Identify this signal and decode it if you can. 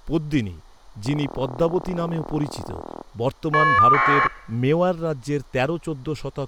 Caller ID data burst, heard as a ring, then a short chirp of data, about 1200 baud, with speech in Bangla.